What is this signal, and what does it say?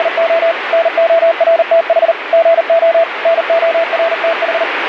Morse code, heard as a keyed tone, machine-sent, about 39 wpm, 660 Hz, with radio static. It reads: … NORTH GO NORTH